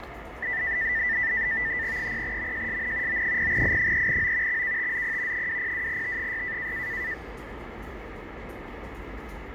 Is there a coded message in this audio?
Yes: NAVTEX (SITOR-B), 100 baud, 170 Hz shift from 0.4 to 7.1 s, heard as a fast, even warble, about 1900 Hz centre, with radio static, fading and the noise of a subway station. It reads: 0MJSN O0I3O XKTZP 202T6